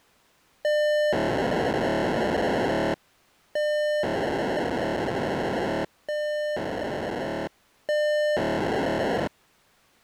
POCSAG pager data (1200 baud), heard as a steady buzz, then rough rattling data.